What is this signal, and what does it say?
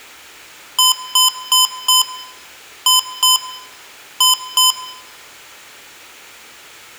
Beep code, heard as beeps from a small speaker, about 1020 Hz, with room echo. 4-2-2. In Phoenix BIOS tables: shutdown test failure.